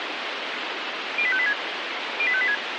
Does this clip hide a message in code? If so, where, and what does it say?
Yes: five-tone selective call (ZVEI) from 1.2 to 2.5 s, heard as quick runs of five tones, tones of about 70 ms, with radio hiss. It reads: 08586 08586